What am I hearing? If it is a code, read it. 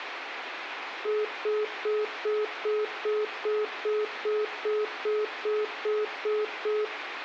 Telephone call progress tone (single-tone plan, as in most of Europe), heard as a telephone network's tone, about 420 Hz, 0.2 s on and 0.2 s off, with phone line noise and room echo. Congestion tone.